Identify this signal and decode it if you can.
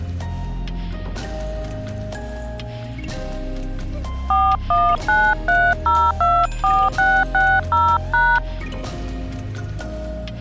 DTMF, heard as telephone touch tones, dialled by hand, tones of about 250 ms. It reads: 4193024660#